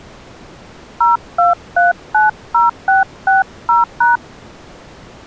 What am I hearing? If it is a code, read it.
DTMF, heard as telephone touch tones, dialled by hand, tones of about 150 ms. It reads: 02390660#